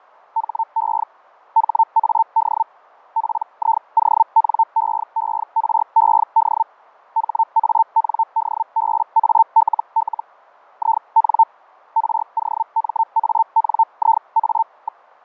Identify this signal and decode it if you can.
Hellschreiber (Feld-Hell, 122.5 baud), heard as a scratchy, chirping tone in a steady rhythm, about 900 Hz, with fading. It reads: HE HAD PIONEERED HANDBALL IN ROMANIA.